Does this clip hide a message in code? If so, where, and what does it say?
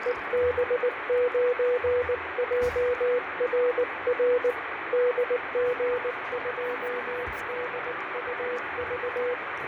Yes: Morse code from 0.0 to 9.4 s, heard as a keyed tone, hand-sent with a paddle, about 19 wpm, 490 Hz, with heavy radio static, fading and the noise of a cafe. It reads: EB9JRR DG2DUV